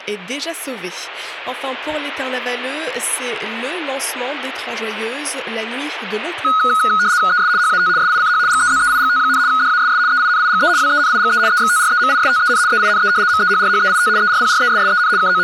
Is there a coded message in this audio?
Yes: RTTY (75 baud, 170 Hz shift) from 6.4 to 15.4 s, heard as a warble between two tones, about 1360 Hz centre. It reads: ES HAT SICH GEZEIGT, DASS EINIGE WENIGE EXTREMISTEN EINE MEHRHEIT ERPRESSEN …